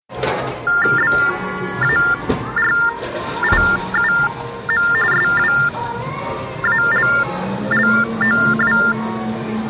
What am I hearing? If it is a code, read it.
TTY/TDD text telephone tones (45.45 baud Baudot), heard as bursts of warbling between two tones, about 400 Hz shift, 1600 Hz centre, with the noise of a cafe. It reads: BARIUM SWALLOW